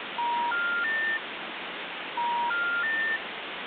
Telephone call progress tone (ITU plan), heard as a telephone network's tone, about 950, 1400, 1800 Hz, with phone line noise. Special information tone.